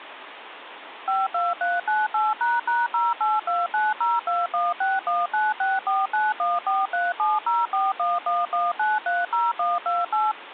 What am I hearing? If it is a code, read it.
DTMF, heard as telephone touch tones, dialled by machine, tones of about 190 ms, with phone line noise. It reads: 52398##0829021619649143704111930128